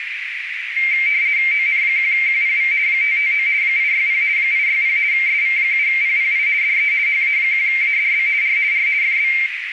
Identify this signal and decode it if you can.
RTTY (50 baud, 170 Hz shift), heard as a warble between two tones, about 2200 Hz centre, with radio static and a narrow filter. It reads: ON1QPV 559 860 860 SV7PPI DE HA1ADB R R FB